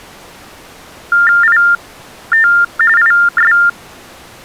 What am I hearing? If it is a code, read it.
TTY/TDD text telephone tones (45.45 baud Baudot), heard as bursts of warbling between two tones, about 400 Hz shift, 1600 Hz centre. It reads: IT IS